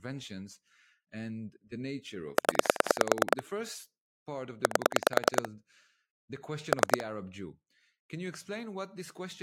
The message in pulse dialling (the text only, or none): 0 8 3